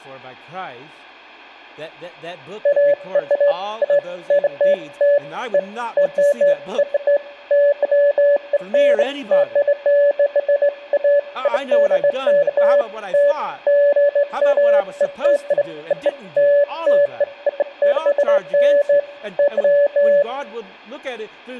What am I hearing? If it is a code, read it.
Beeps of irregular length, with room echo and speech in English. There is no code.